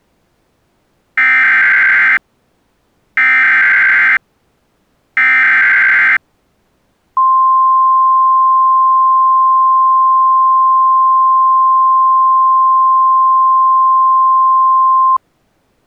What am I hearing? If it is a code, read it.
Emergency Alert System (SAME) tones (header bursts, then the 1050 Hz attention tone), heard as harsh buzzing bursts, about 520.83 baud.